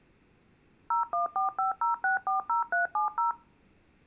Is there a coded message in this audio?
Yes: DTMF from 0.9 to 3.3 s, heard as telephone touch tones, dialled by machine, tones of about 130 ms. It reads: 01450640370